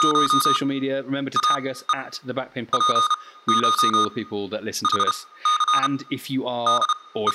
Morse code (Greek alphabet), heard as electronic beeps, machine-sent, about 32 wpm, spaced as for 18 wpm, 1230 Hz, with room echo and speech in English. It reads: … ΑΕ ΠΧ ΗΘ …